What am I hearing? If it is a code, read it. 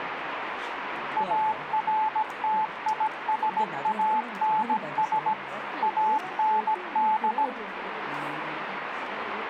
Morse code, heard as a keyed tone, machine-sent, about 17 wpm, 870 Hz, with radio static and the noise of a crowd indoors. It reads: ARTISANS AND